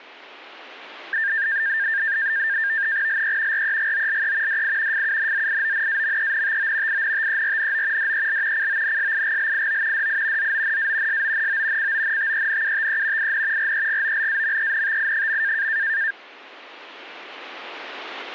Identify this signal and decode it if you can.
NAVTEX (SITOR-B), 100 baud, 170 Hz shift, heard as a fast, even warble, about 1700 Hz centre. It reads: LE REGOLE DI FUNZIONAMENTO INTERNO DEL CONSIGLIO DI ZONA SONO CONTENUTE IN REGOLAMENTI.